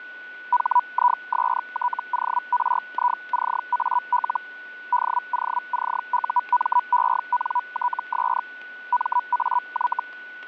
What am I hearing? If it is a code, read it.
Hellschreiber (Feld-Hell, 122.5 baud), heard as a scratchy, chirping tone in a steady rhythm, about 980 Hz, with static crashes and a steady whistle near 1480 Hz. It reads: HISTORICAL DOCUMENTS MAY